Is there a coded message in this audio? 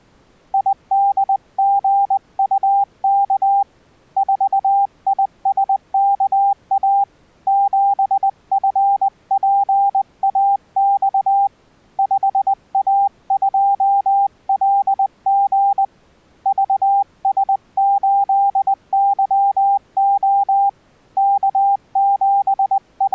Yes: Morse code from 0.5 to 23.1 s, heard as a keyed tone, hand-sent with a paddle, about 20 wpm, 800 Hz. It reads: IDGUK 4ISKA 7FPAX 5A2LG VS8YO …